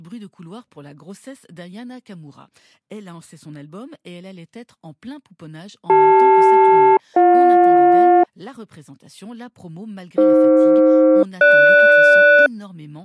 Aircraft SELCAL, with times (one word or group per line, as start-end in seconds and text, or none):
5.9-8.2 CL-BJ
10.2-12.5 AF-GS